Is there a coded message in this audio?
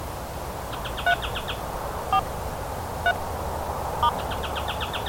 Yes: DTMF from 1.1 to 4.1 s, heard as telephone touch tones, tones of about 70 ms. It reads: 3 4 3 *